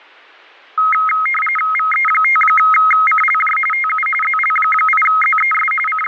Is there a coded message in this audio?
Yes: RTTY (45.45 baud, 850 Hz shift) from 0.8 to 6.1 s, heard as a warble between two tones, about 1700 Hz centre. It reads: VE5CLJ TU ZL8ZES …